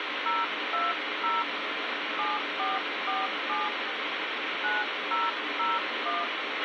DTMF, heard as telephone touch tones, dialled by hand, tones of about 190 ms, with radio hiss and a squelch burst at the end. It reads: 020 7447 9001